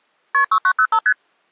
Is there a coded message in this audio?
Yes: multi-frequency trunk signalling (R1, as on North American trunks) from 0.3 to 1.1 s, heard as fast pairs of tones, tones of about 70 ms. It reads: KP 6905 ST